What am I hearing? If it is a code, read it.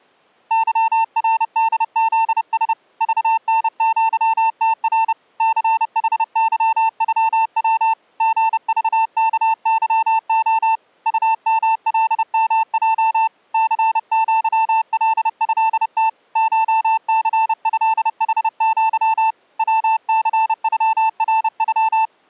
Morse code (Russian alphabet), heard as a keyed tone, hand-sent with a paddle, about 30 wpm, 890 Hz. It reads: ЫРДЗС ЖНЪТР ЦХЫЮВ ГЖКЫО УМЛМЙ ЦЪЛЭТ ШЦЭХЪ ВЦЮРЮ